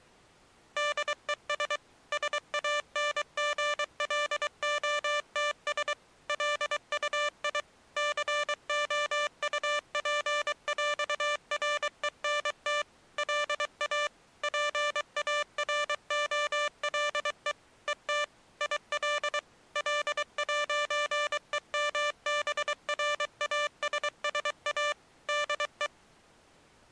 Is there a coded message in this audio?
Yes: Morse code (with French letters) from 0.7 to 25.9 s, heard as electronic beeps, machine-sent, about 23 wpm, 590 Hz. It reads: DES SANGLOTS LUI COUPÈRENT LA PAROLE ET IL L'EMBRASSA DE